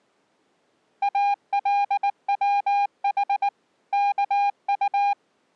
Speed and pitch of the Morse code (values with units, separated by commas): 19 wpm, 810 Hz